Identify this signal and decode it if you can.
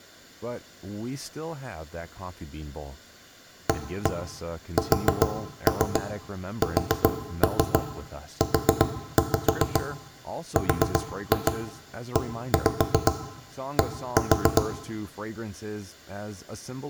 Tap code, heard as knocks on wood, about 7 knocks a second, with room echo and speech in English. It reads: ASSURED